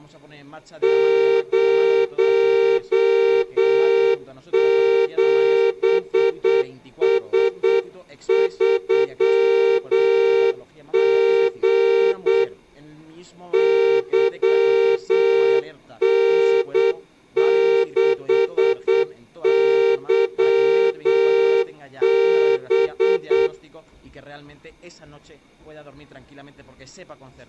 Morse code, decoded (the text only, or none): 07S3G YN6YB